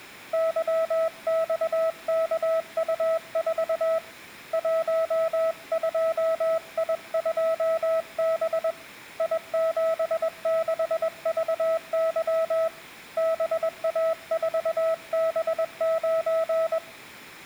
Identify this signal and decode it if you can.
Morse code, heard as a keyed tone, hand-sent with a paddle, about 21 wpm, 650 Hz. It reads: YXKU4 12I2B I76VY BA4B9